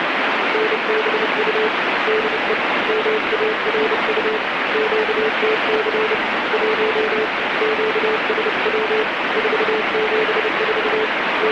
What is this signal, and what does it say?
Morse code, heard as a keyed tone, hand-sent with a paddle, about 30 wpm, 430 Hz, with heavy radio static. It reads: NBU DE MARU QTC 1 QSW 474 …